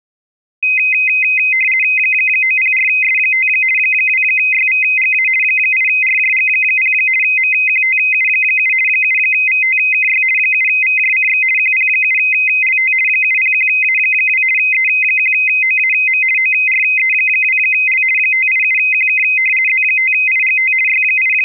RTTY (50 baud, 450 Hz shift), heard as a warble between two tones, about 2300 Hz centre. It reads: 904S5 2YVGA 8RJG0 MQTU7 7VTKY 7VJCX QP7LT 701A2 E1OAM ORE2L 587QK Z5IGT …